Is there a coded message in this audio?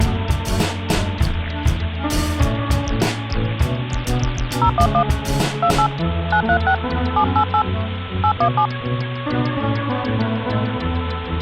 Yes: DTMF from 4.6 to 8.7 s, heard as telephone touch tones, dialled by hand, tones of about 80 ms. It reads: 011 28 936 788 817